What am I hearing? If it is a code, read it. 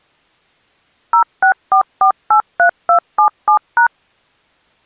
DTMF, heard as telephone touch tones, dialled by machine, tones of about 100 ms. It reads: 064483277#